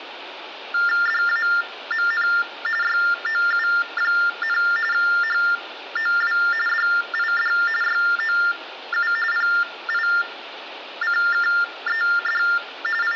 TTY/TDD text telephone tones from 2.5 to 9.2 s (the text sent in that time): YOU, HOW DID YOU